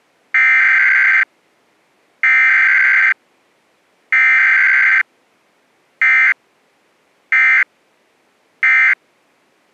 Emergency Alert System (SAME) tones (header bursts, then end-of-message bursts), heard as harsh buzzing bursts, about 520.83 baud.